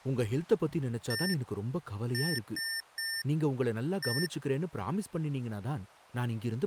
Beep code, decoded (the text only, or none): 1-3-1